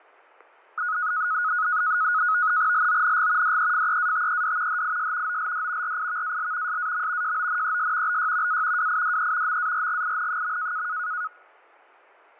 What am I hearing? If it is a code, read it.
NAVTEX (SITOR-B), 100 baud, 170 Hz shift, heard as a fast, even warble, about 1360 Hz centre, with fading and static crashes. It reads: LONG DEFEATED HIS OLD RIVAL SAM JONES BY A WIDE MARGIN.